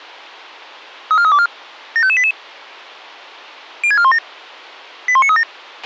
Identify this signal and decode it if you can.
Five-tone selective call (ZVEI), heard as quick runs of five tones, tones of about 70 ms, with a squelch burst at the end. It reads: 34324 75588 06417 81937